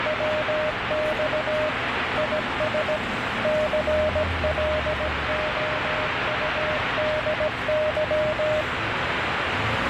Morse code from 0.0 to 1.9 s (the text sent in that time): WX